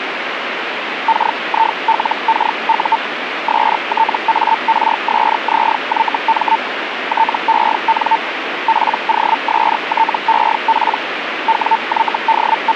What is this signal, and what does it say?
Hellschreiber (Feld-Hell, 122.5 baud), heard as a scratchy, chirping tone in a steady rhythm, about 900 Hz, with radio static. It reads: KILKU STARSZYM TEN POSTEP …